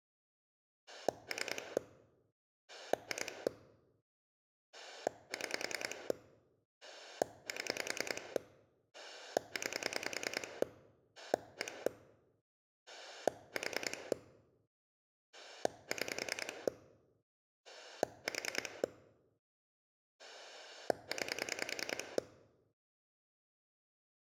Pulse dialling, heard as a rotary dial, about 10 pulses a second. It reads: 3 2 6 7 9 1 4 6 4 9